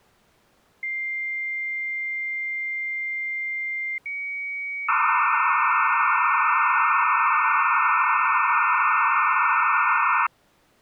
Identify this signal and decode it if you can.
Dial-up modem handshake (low-speed, two carriers), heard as two whistles, then hiss.